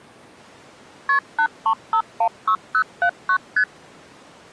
Multi-frequency trunk signalling (R1, as on North American trunks), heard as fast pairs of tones, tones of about 80 ms. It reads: KP 83516079 ST